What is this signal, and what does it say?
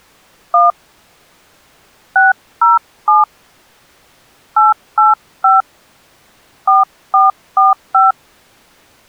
DTMF, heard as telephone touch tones, dialled by hand, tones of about 160 ms. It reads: 1 607 885 4445